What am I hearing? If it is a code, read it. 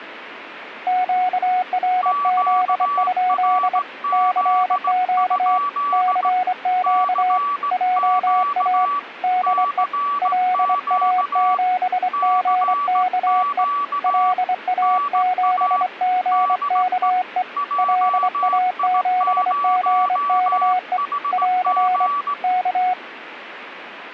Morse code, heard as two keyed tones, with radio static. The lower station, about 24 wpm, 730 Hz: QRZ? CQ CQ JA DE LA7GKE LA7GKE LA7GKE <AR> K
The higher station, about 17 wpm, 1150 Hz: QRZ? CQ CQ CQ NA DE JI0HG